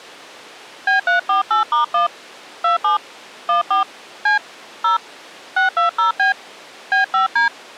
DTMF, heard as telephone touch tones, dialled by hand, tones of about 130 ms. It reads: B348*1 27 14 C 0 620B B5D